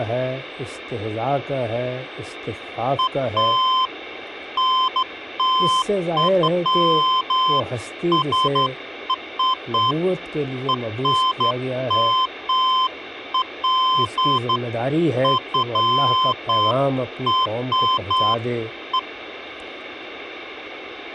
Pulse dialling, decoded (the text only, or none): none